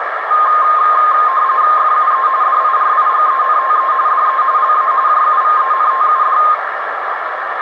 RTTY (45.45 baud, 170 Hz shift), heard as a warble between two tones, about 1150 Hz centre, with radio static and a narrow filter. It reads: FUE DIRIGENTE DE LA JUVENTUD